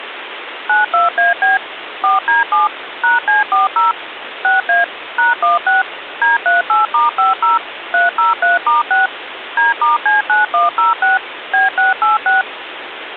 DTMF, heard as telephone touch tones, dialled by machine, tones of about 150 ms, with phone line noise. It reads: 92AB 4D7 #C40 6A #16 D38*50 303*6 D*C9106 B686